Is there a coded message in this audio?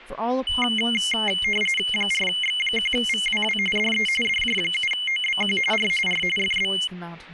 Yes: RTTY (45.45 baud, 850 Hz shift) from 0.5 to 6.9 s, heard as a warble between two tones, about 2550 Hz centre, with static crashes and speech in English. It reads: 4X1VWW DE DJ7OBQ R R FB